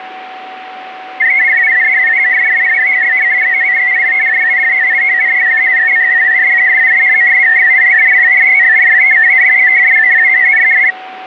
Multi-tone FSK (Olivia or MFSK type), about 500 Hz wide, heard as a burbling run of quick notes, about 62.5 baud, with a steady whistle near 750 Hz.